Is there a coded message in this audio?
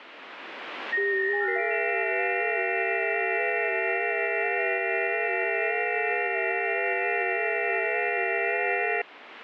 Yes: FT8 (several signals at once) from 0.9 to 9.0 s, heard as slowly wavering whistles, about 6.25 baud, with radio static.